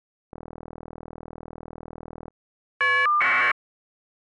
Caller ID data burst, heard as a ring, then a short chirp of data, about 1200 baud.